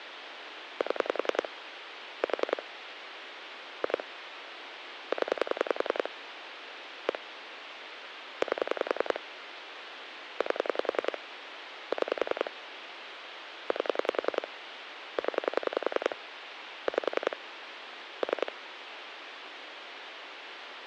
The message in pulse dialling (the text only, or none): 7 4 2 0 1 8 8 6 8 0 5 3